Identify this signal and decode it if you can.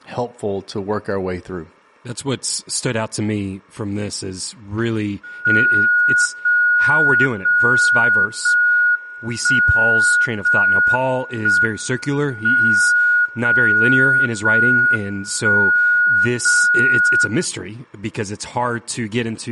Radio time signal (JJY), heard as a tone whose level steps once a second, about 1450 Hz, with speech in English. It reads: 0 0 0 1 0 1 M 0 0 1 0 0